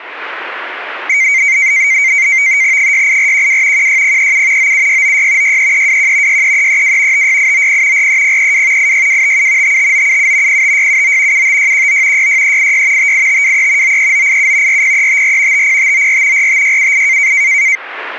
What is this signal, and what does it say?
NAVTEX (SITOR-B), 100 baud, 170 Hz shift, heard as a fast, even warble, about 2200 Hz centre. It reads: 68412 16037 97696 63321 63332 56890 43032 86257 55977 05679 75619 66386 58523 93987 40354 50594 45678